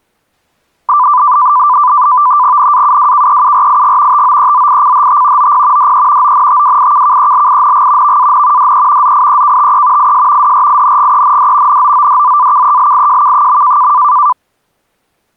NAVTEX (SITOR-B), 100 baud, 170 Hz shift, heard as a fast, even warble, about 1090 Hz centre. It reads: NAUWKEURIG TOEZICHT OP DE ONTWIKKELING VAN DE ZIEKTE IS DRINGEND NOODZAKELIJK.